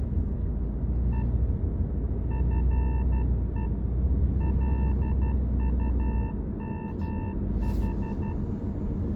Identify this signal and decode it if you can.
Morse code, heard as a keyed tone, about 12 wpm, 890 Hz, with room echo and the noise inside a car. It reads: E FE LUMH